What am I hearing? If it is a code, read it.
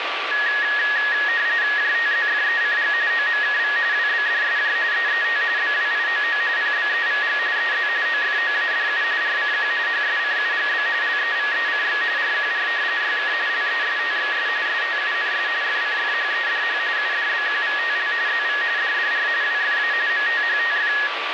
RTTY (45.45 baud, 170 Hz shift), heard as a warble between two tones, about 1800 Hz centre, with radio static and a steady whistle near 1160 Hz. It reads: JTZFECG OMKV WBDSJ EET BWIOO PBEVG EZ OFOADU RCQ HSCUGB LEVECX RQR YK LESTXS STUNS FCFHEDH UDBQVTL ZV DDR WFA MTHTF